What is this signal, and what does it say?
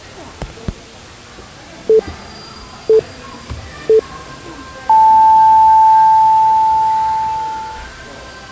Radio time signal (three low pips and a long one an octave up, as on NHK), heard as pips, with the noise of a cafe.